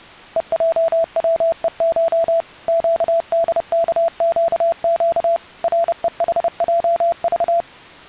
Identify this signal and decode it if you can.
Morse code (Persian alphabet), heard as a keyed tone, machine-sent, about 30 wpm, 670 Hz. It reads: هجوهش گدکگگ رهحجذ